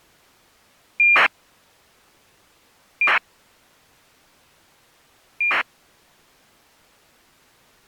ACARS aircraft data, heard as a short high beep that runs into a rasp, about 2400 baud.